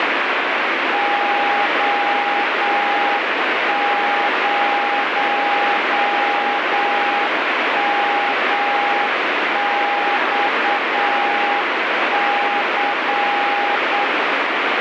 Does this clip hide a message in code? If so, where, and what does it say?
Yes: Morse code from 0.9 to 14.1 s, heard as a keyed tone, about 8 wpm, 820 Hz, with heavy radio static. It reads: O0MXC